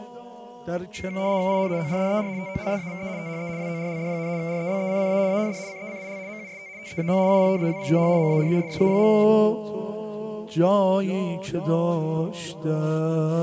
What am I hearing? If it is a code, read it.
RTTY (75 baud, 170 Hz shift), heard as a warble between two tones, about 2200 Hz centre. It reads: IN ORDER TO SAVE THE WORLD, REBECCA AND CECIL MUST TEAM UP WITH MARISSA.